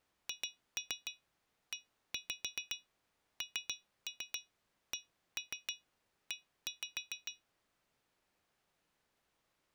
Tap code, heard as taps on glass, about 6 knocks a second. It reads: HENCE